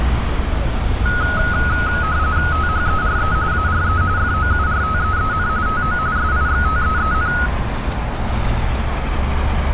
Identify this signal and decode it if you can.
RTTY (45.45 baud, 170 Hz shift), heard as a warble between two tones, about 1360 Hz centre, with static crashes, a steady whistle near 730 Hz and street noise. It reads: THERE ARE FOURTEEN TO SIXTEEN